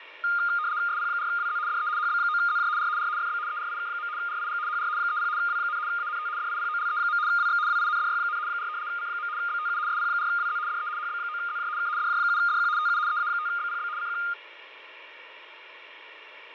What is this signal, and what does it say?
RTTY (75 baud, 170 Hz shift), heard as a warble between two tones, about 1320 Hz centre, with radio static and fading. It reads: SP4WZ DE HB9ZJ R R FB ERIK. RIG HR 30 W, ANT DIPOLE. WX WINDY, 4 C. BTU SP4WZ DE HB9ZJ K DJ7DQ TU EA5BPB CQ